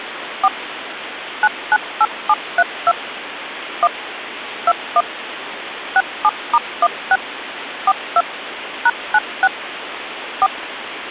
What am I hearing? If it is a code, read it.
DTMF, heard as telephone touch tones, dialled by machine, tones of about 50 ms, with phone line noise. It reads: 4 998732 1 21 67*16 42 #96 4